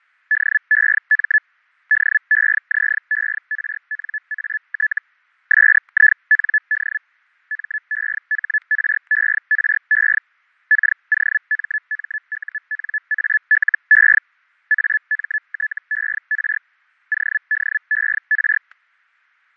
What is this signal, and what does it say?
Hellschreiber (Feld-Hell, 122.5 baud), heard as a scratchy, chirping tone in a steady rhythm, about 1700 Hz, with fading and static crashes. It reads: DEM DEZERNAT SIND MEHRERE KOMMUNALE AMTER ODER